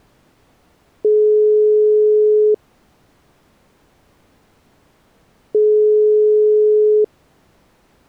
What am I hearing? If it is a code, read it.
Telephone call progress tone (single-tone plan, as in most of Europe), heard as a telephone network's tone, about 420 Hz, 1.5 s on and 3 s off. Ringback tone.